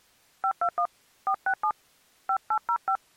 DTMF, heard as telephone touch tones, dialled by hand, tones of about 80 ms. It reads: 521 467 5805